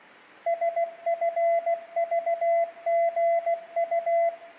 Morse code, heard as a keyed tone, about 16 wpm, 680 Hz, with room echo. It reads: SFVGU